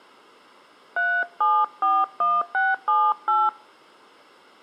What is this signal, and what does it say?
DTMF, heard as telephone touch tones, dialled by hand, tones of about 240 ms. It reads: 3741678